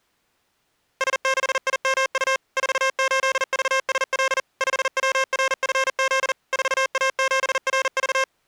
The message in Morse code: S6IMU 48VSL 5WRFZ 4A7RV

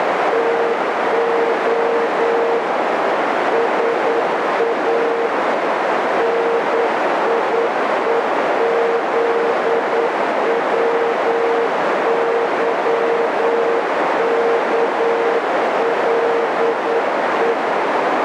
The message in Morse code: TO SA NIEZWYKLE

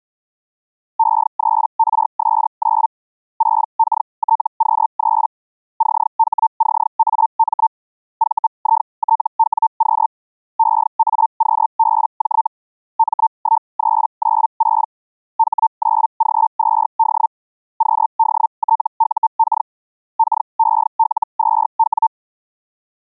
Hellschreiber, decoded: E3RS9 6KTQ3 CHCAM VITWQ EAQBJ M1396 H9G2D QDTUK KEL2W

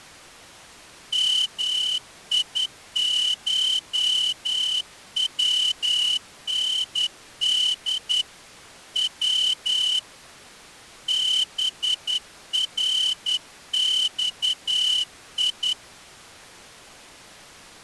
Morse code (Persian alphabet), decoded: میشوند و برخی

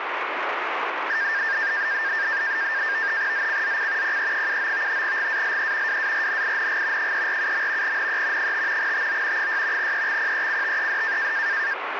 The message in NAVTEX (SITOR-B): ZCZC PE79 GALE WARNING 347. NE 5 TO 6 EXPECTED

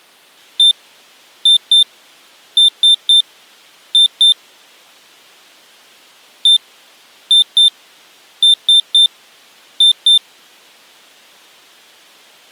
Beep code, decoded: 1-2-3-2

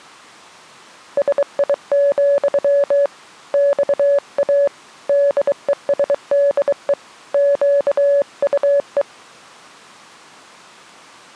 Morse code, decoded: SI, XA DESDE QUE

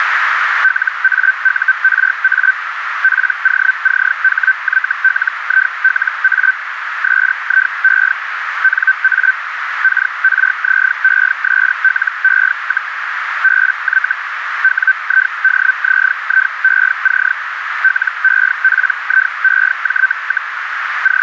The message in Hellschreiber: LAURA POCHYLILA SIE NA KRZESLE, BY WIDZIEC LEPIEJ, …

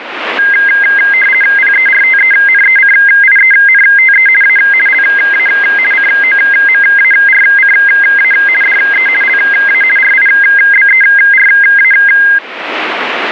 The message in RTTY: PERTENECIENTE A LA COMARCA DE LA RIBERA

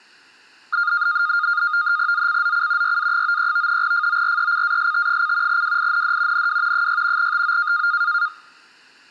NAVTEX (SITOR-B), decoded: ZCZC YA93 FORECAST: WIND NW 6 TO

